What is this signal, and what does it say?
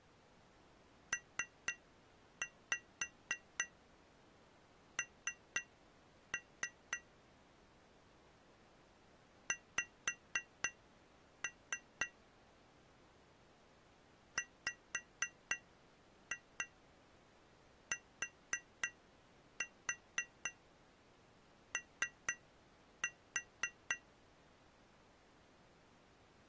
Tap code, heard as taps on glass, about 4 knocks a second. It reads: PN X WTO